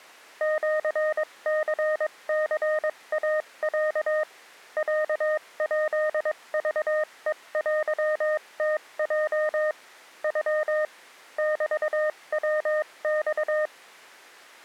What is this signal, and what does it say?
Morse code (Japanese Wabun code), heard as a keyed tone, machine-sent, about 22 wpm, spaced as for 19 wpm, 620 Hz. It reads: シニニイロ ロヱクヘテムヲ ノ メヤマ